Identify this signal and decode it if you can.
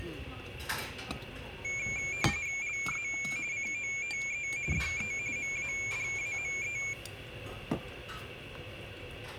RTTY (45.45 baud, 170 Hz shift), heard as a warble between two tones, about 2300 Hz centre, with radio static and the noise of a restaurant. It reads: LA COTE DE MADAME